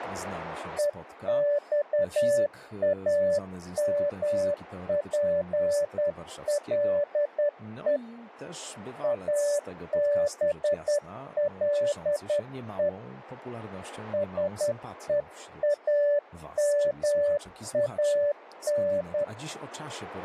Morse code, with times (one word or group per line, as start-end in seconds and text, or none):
0.8-8.0 EXAMPLE
9.0-12.9 ABLE
14.1-19.2 SEAMAN